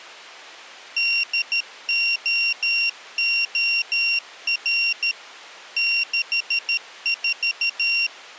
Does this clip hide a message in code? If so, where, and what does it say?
Yes: Morse code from 0.9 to 8.1 s, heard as a high beeper, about 13 wpm, 2750 Hz. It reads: DOOR 64